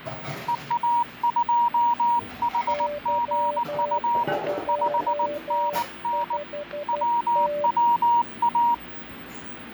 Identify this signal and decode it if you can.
Morse code, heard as two keyed tones, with the noise of a cafe. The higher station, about 19 wpm, 950 Hz: EA2HGU 5NN WWA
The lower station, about 12 wpm, 590 Hz: Y25T